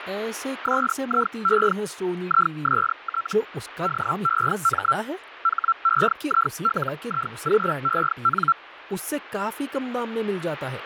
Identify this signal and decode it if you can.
Hellschreiber (Feld-Hell, 122.5 baud), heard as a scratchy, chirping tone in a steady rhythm, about 1350 Hz, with radio static and speech in Hindi. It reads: SIE IST DEM HEILIGEN